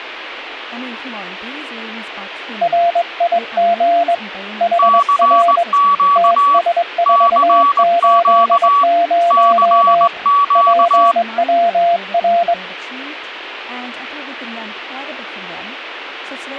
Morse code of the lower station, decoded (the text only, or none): RIG HR TS480 PWR